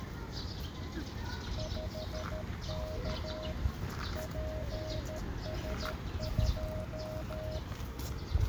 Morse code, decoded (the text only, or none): 5K PS2